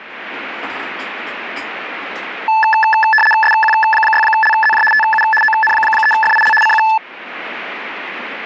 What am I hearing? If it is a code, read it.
RTTY (75 baud, 850 Hz shift), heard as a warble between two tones, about 1300 Hz centre, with radio static and kitchen noise. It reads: SQ6LZJ TU ON3FIL CQ